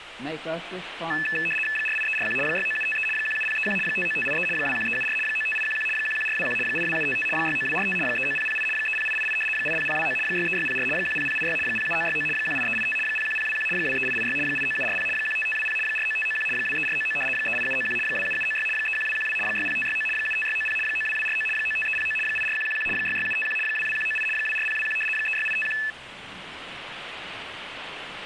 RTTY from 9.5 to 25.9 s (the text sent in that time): 80029 63604 10086 07969 18385 01021 23886 89740 15520 49591 23499 38791 27796 31212 60569 75690 92249 95309 84111 66751 22198 24021 36851